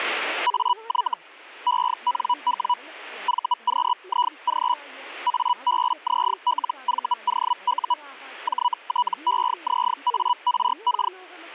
Hellschreiber (Feld-Hell, 122.5 baud), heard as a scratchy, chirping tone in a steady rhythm, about 980 Hz, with speech in Sanskrit. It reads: AY ENW VQIG ABZLVOU JTEZARK